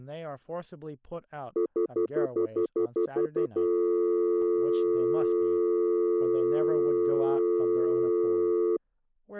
Telephone call progress tone (North American plan), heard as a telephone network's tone, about 350, 440 Hz, 0.1 s on and 0.1 s off, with speech in English. Stutter dial tone.